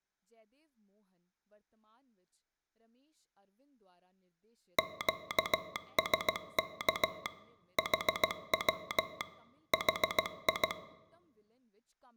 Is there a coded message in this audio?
Yes: Morse code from 4.7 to 10.8 s, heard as a telegraph sounder, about 16 wpm, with speech in Punjabi. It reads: QSK HW HI